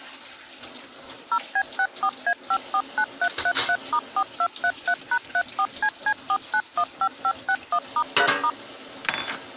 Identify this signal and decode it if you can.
DTMF, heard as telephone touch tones, dialled by machine, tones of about 70 ms, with kitchen noise. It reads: 0B64A549333*4233#34CC4915561*3*